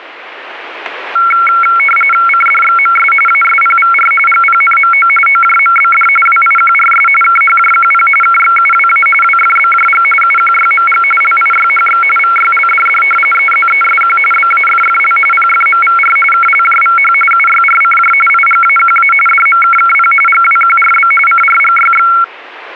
RTTY (45.45 baud, 850 Hz shift), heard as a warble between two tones, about 1800 Hz centre, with radio static. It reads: CDXMS ASPVR GPNMO OJMBD WIQRS KHJQP KXUWA WFBJG UQYMG LIYHX VYLDD EZESQ BAFFL PFMVR KLJVH UYRCJ IGAQA DMKKP GWQRB CRGYX